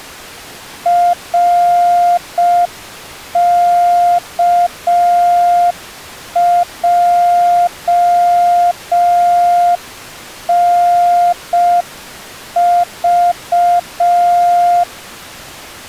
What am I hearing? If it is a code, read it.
Morse code, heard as a keyed tone, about 5 wpm, 700 Hz. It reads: RKJNV